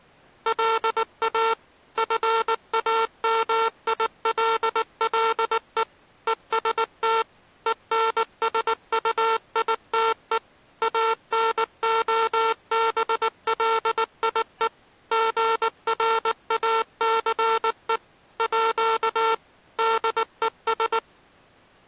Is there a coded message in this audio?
Yes: Morse code (with French letters) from 0.4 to 21.0 s, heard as a buzzer, machine-sent, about 19 wpm. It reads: LA FAMILLE EST ENSUITE ANOBLIE GRACE À DES